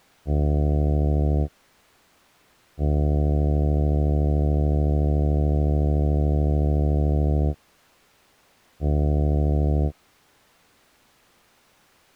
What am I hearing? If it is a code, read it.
Ship horn signal, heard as a ship's horn, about 70 Hz. 1 short, 1 long, 1 short. At sea: a vessel at anchor warns of its position.